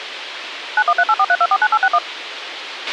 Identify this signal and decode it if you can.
DTMF, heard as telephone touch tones, dialled by machine, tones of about 50 ms, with radio hiss and a squelch burst at the end. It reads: 913843249861